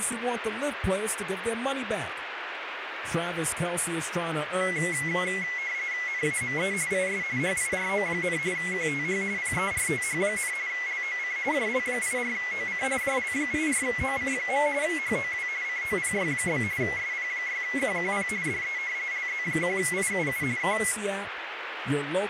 RTTY (45.45 baud, 170 Hz shift), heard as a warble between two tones, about 2050 Hz centre, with radio static. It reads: NAME IS HIRO, QTH PERTH, LOC JL84OC JL84OC. HOW COPY? SP6QQP DE LZ1IUU K